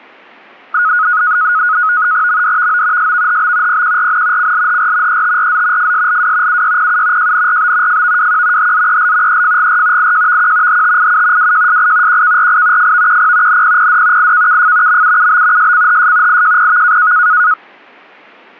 NAVTEX (SITOR-B), 100 baud, 170 Hz shift, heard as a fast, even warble, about 1360 Hz centre. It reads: MDVO SVHB PQRN CLHR ETRZ FSLW UYPU JNRB FVWQ HZEL EFGR IJVQ HTIU WJSI QKRI FVQP NPPD IKKF MUUB SCHS IJPV